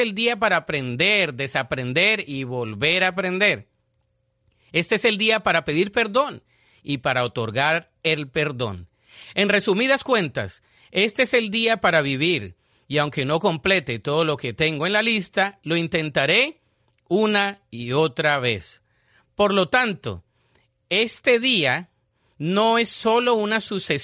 Speech in Spanish. There is no code.